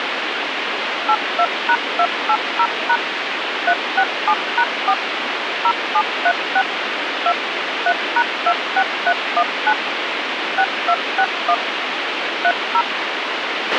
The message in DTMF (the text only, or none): 82#280# 367#4 0736 2 3#26319 6261 30